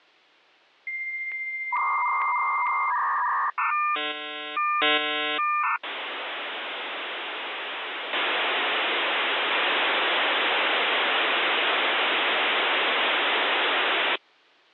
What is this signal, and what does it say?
Dial-up modem handshake (V.34 or later), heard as a whistle, warbles, then hiss.